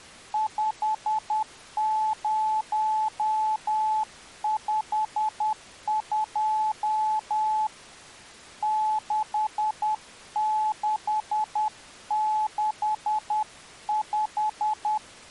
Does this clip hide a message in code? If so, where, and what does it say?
Yes: Morse code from 0.3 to 15.0 s, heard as a keyed tone, hand-sent with a paddle, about 10 wpm, 860 Hz. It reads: 5052 6665